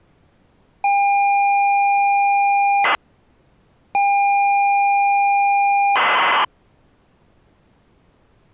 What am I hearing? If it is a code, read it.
ZX Spectrum tape loading, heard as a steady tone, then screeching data.